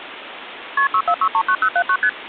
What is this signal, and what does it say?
Multi-frequency trunk signalling (R1, as on North American trunks), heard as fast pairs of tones, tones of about 70 ms, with phone line noise. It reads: KP 64639079 ST